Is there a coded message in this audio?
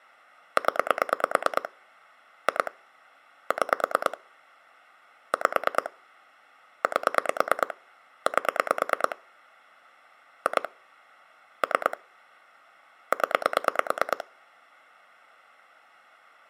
Yes: pulse dialling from 0.6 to 14.2 s, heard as clicks on a phone line, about 9 pulses a second. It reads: 0 2 6 5 8 8 2 3 0